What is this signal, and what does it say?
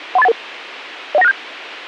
Five-tone selective call (EIA), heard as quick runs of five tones, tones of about 30 ms, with radio hiss. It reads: 13811 01967